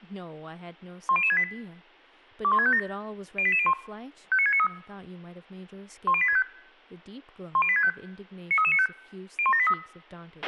Five-tone selective call (ZVEI), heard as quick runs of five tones, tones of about 70 ms, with a squelch burst at the end and speech in English. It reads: 10068 21657 08801 59693 10865 10865 93395 01783